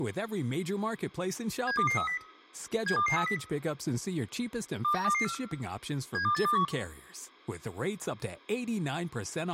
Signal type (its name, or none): five-tone selective call